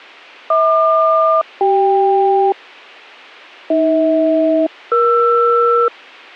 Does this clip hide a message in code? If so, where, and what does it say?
Yes: aircraft SELCAL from 0.5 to 5.9 s, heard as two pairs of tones. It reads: HQ-CK AH-ER